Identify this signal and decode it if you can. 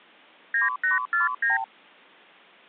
Multi-frequency trunk signalling (R2, with the far end's replies), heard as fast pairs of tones, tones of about 150 ms. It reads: 9849